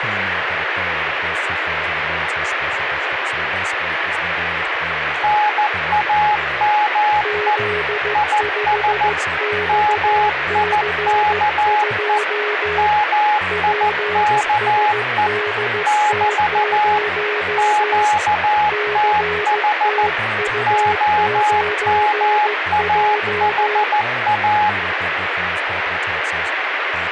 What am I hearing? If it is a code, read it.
Morse code, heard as two keyed tones, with radio static and speech in English. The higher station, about 14 wpm, 840 Hz: NAME IS MIKE MIKE <BT> QTH OMAHA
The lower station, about 15 wpm, 420 Hz: Z5XC2 PSDT0 CTU9J